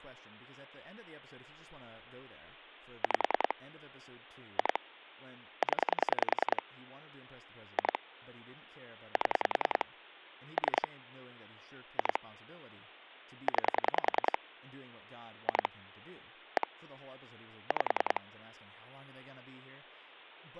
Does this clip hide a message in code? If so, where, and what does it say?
Yes: pulse dialling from 3.0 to 18.2 s, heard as clicks on a phone line, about 10 pulses a second, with hum and speech in English. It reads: 5 2 0 2 7 3 2 9 2 1 5